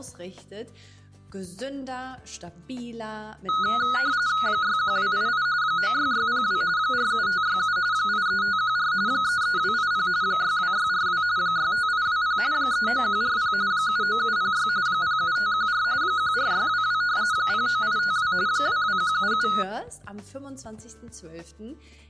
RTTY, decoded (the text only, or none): 61288 96602 47567 83514 33280 62642 65820 39140 79706 07514 14622 09852 22177